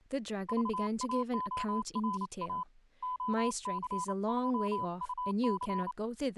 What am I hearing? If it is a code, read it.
Morse code, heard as a keyed tone, hand-sent with a paddle, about 29 wpm, 1000 Hz, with speech in English. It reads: VAORA OCJUC